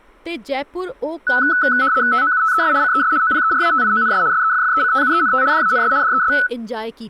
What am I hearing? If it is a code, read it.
RTTY (75 baud, 170 Hz shift), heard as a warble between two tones, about 1400 Hz centre, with speech in Dogri. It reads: TOUTES CES OPERATIONS SEFFECTUENT DANS DES